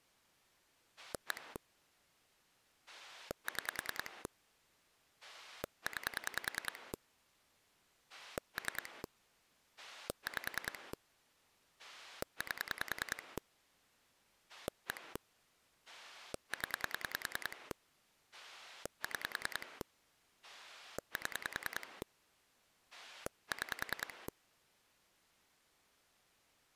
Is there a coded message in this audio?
Yes: pulse dialling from 1.0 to 24.3 s, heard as a rotary dial, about 10 pulses a second. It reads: 1 6 9 3 5 8 1 0 6 7 6